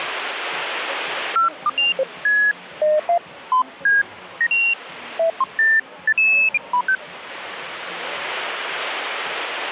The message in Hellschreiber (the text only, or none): none